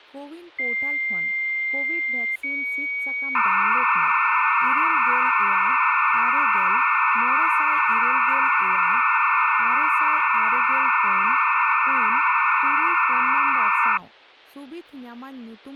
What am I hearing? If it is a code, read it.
Dial-up modem handshake (low-speed, two carriers), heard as two whistles, then hiss, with speech in Santali.